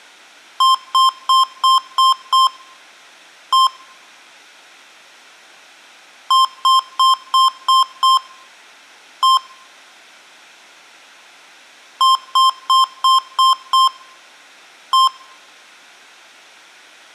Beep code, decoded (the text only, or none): 6-1